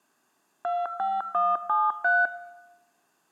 DTMF, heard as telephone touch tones, dialled by machine, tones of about 210 ms, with room echo. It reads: 25173